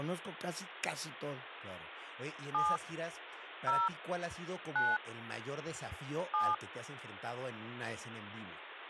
DTMF, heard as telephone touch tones, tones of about 210 ms, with phone line noise and speech in Spanish. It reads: 7 0 9 7